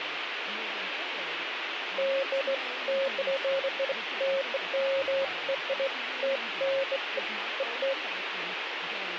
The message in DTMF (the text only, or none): none